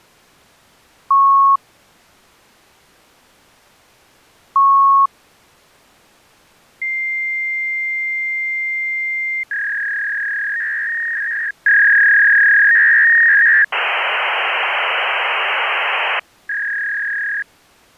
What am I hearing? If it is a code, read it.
Fax machine handshake, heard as beeps, a long tone, a warble and hiss.